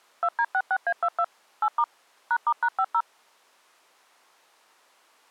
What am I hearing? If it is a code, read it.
DTMF, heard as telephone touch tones, dialled by machine, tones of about 60 ms. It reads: 2D66A22 8* #*#50